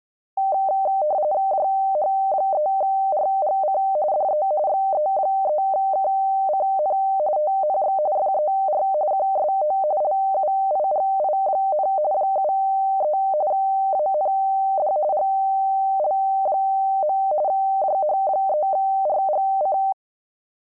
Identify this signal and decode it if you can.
RTTY (45.45 baud, 170 Hz shift), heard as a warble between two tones, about 690 Hz centre. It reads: JH3RGC DE XE3KCN TNX FER QSO LUIGI, 73 AND GL. JH3RGC